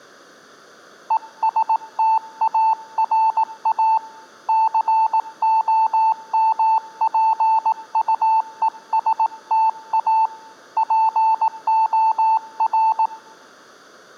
Morse code, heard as a keyed tone, hand-sent with a paddle, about 18 wpm, 890 Hz. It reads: ESTARA COMPUESTA POR